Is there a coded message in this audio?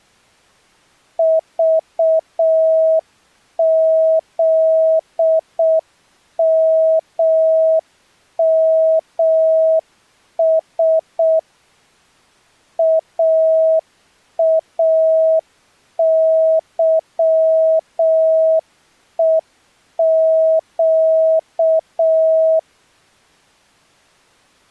Yes: Morse code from 1.1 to 22.7 s, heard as a keyed tone, machine-sent, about 6 wpm, 640 Hz. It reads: VZMMS AAYEQ